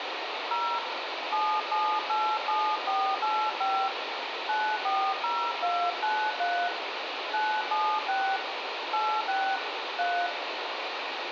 DTMF, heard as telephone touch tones, dialled by hand, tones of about 280 ms, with radio hiss and room echo. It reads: 0 7787485 940293 976 86 3